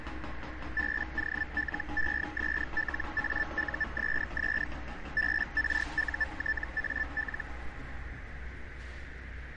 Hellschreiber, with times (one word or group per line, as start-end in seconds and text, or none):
0.8-4.6 BOLESLAUSS
5.2-7.4 BRUTAL